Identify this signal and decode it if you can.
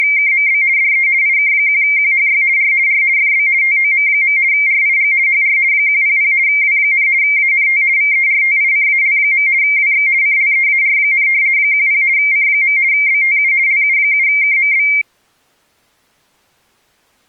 RTTY (50 baud, 170 Hz shift), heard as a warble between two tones, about 2200 Hz centre. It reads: … DE IK1QHY R R FB TOM. RIG HR 100 W, ANT VERTICAL. WX CLEAR, 10 C. BTU LU7KMB